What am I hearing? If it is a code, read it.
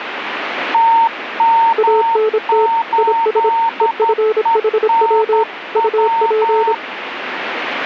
Morse code, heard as two keyed tones, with radio static. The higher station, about 11 wpm, 910 Hz: TM8ENW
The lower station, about 26 wpm, 440 Hz: ANT IS EFHW UP